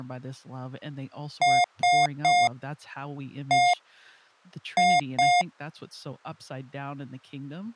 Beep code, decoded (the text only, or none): 3-1-2